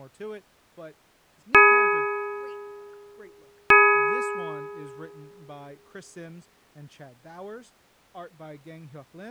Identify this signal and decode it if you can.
Clock strike, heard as a bell, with speech in English. 2. Two o'clock.